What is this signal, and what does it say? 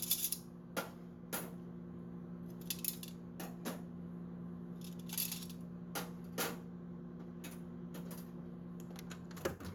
Kitchen noise. There is no code.